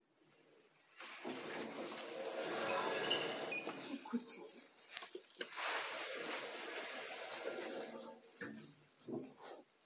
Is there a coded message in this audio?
No, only the noise inside a lift.